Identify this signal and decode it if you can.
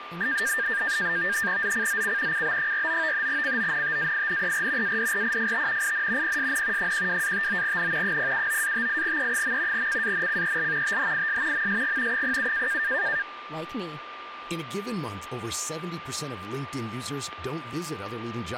NAVTEX (SITOR-B), 100 baud, 170 Hz shift, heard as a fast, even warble, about 1700 Hz centre, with radio static, a steady whistle near 1190 Hz and speech in French. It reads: ZCZC CB49 CONTAINER ADRIFT IN PSN 12-59N 079-58E. CANCEL THIS MSG 07